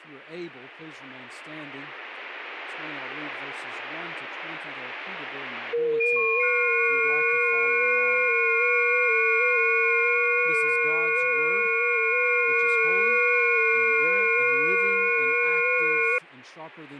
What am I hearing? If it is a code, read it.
FT8 (several signals at once), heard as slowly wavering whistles, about 6.25 baud.